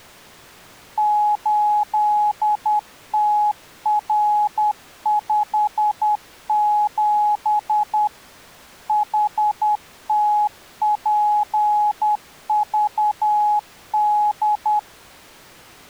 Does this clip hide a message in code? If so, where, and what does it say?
Yes: Morse code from 0.9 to 14.9 s, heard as a keyed tone, machine-sent, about 10 wpm, 840 Hz. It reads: 8TR57 HTPVD